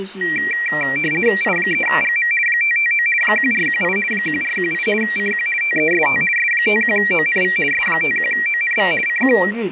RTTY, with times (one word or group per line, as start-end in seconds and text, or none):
1.4-2.3 I3GM
2.5-3.1 559
3.2-4.0 1418
4.1-4.9 1418
5.0-5.5 CQ
5.6-6.2 TEST
6.4-7.6 S51ONV
7.7-8.9 S51ONV
9.1-9.4 CQ